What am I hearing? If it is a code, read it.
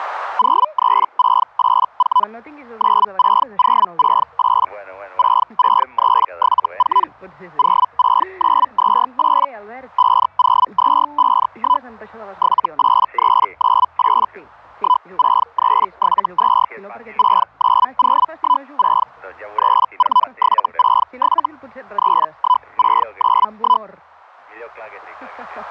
Hellschreiber (Feld-Hell, 122.5 baud), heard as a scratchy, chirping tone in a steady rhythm, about 1000 Hz. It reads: 03684 96068 66374 06928 50251 78398 16372 69016 34767 31691